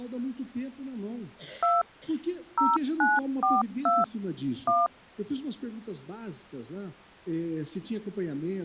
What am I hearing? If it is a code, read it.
DTMF, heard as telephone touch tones, dialled by machine, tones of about 190 ms. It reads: 2 0942 1